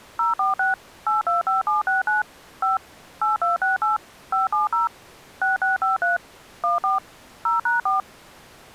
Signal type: DTMF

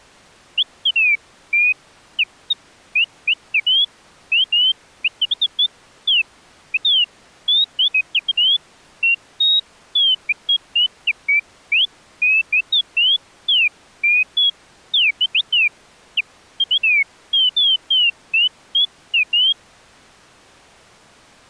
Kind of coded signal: none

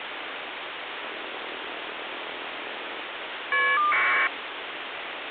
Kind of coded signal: caller ID data burst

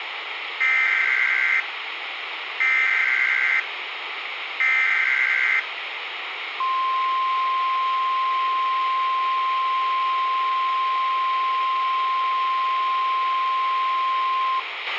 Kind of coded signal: Emergency Alert System (SAME) tones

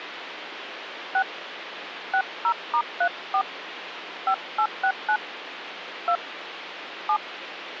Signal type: DTMF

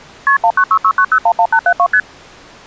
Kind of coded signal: multi-frequency trunk signalling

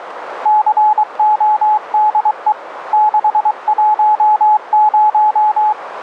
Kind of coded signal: Morse code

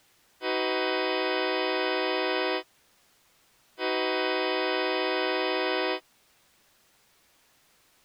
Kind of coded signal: train horn signal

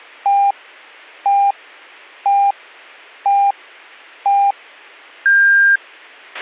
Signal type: radio time signal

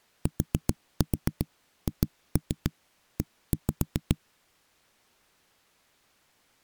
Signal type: tap code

